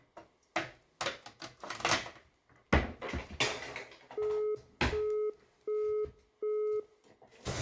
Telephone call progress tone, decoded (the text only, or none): busy tone